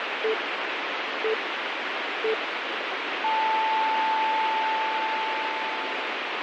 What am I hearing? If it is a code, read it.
Radio time signal (three low pips and a long one an octave up, as on NHK), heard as pips, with radio static.